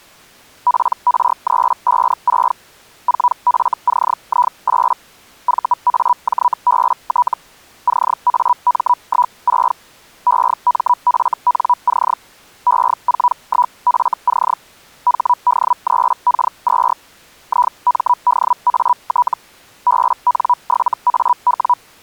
Hellschreiber (Feld-Hell, 122.5 baud), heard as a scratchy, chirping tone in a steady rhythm, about 980 Hz. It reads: PR356 4FCI8 VAJBT CAM16 EMFNC E41FC HD3K2 IMDAT BN7AW